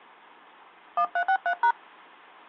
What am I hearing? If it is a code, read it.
DTMF, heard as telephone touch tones, dialled by hand, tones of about 80 ms. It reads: 1363#